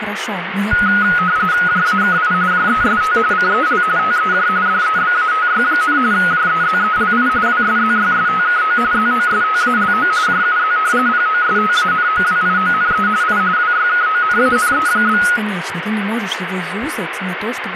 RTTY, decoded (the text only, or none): JAKI JEST CEL TEJ DEBATY, JEZELI WSZYSTKO ZOSTALO JUZ POSTANOWIONE I WYKONANE?